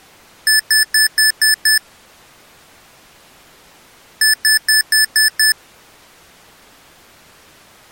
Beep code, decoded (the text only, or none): 6 short